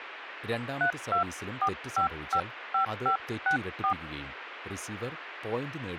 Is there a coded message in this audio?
Yes: DTMF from 0.8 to 3.9 s, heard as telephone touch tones, dialled by hand, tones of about 100 ms, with radio hiss, a squelch burst at the end and speech in Malayalam. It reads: 324555564